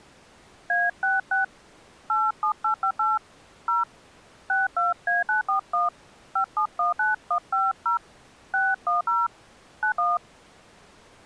DTMF, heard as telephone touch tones, dialled by hand, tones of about 140 ms. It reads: A66 87858 0 62A941 5719150 610 91